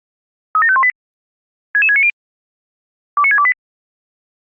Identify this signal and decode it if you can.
Five-tone selective call (ZVEI), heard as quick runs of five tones, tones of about 70 ms. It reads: 37518 66690 29628